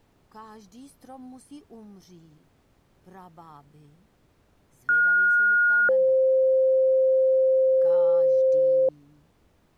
Two-tone page, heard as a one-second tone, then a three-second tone, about 1430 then 520 Hz.